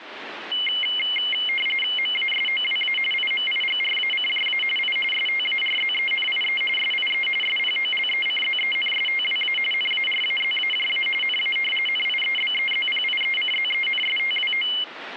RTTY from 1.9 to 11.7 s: MASOWA IMIGRACJA I STARZENIE SIE SPOLECZENSTWA NARAZAJA NA

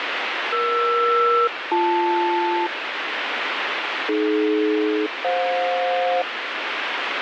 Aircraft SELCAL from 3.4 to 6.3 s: AD-FJ

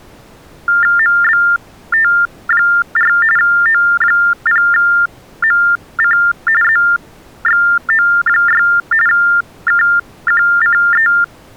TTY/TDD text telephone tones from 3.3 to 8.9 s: O0MC ZXO6

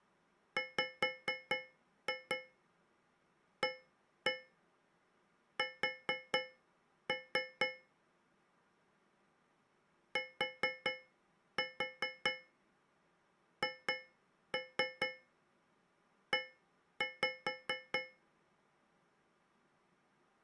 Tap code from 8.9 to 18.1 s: THE

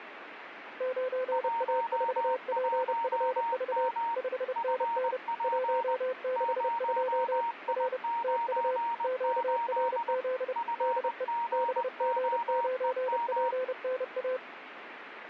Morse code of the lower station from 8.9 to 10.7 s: QRZ

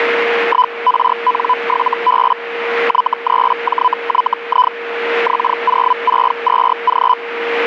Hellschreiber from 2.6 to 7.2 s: Y3JYI X062G

